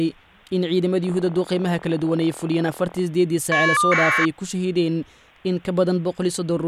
Caller ID data burst, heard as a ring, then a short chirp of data, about 1200 baud.